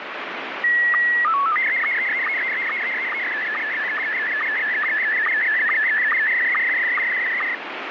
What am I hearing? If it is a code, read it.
SSTV (slow-scan television), Scottie S1, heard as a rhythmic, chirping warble, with heavy radio static.